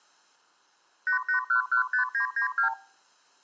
Multi-frequency trunk signalling (R2, with the far end's replies), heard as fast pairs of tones, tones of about 110 ms. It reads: 88115992